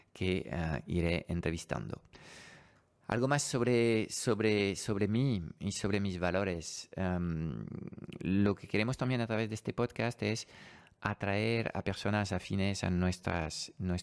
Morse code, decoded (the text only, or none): none